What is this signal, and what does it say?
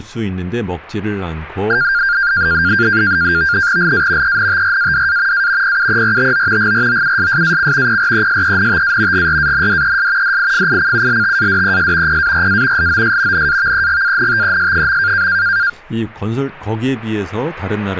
NAVTEX (SITOR-B), 100 baud, 170 Hz shift, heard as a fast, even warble, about 1500 Hz centre, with speech in Korean. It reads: LA ENTRADA A PUERTO GROUSSAC PRESENTA GRANDES DIFICULTADES PARA LOS NAVEGANTES.